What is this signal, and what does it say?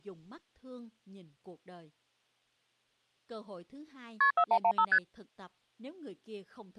Multi-frequency trunk signalling (R1, as on North American trunks), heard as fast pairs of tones, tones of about 70 ms, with speech in Vietnamese. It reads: KP 4115 ST